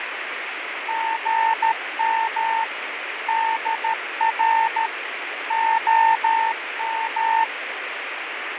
Morse code, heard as a keyed tone, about 13 wpm, 900 Hz, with radio static and fading. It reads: GM DR OM